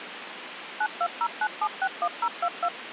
DTMF, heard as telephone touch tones, dialled by machine, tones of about 60 ms, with phone line noise. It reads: 9209761022